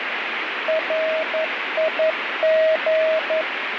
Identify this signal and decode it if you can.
Morse code, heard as a keyed tone, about 11 wpm, 640 Hz, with radio static and fading. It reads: RIG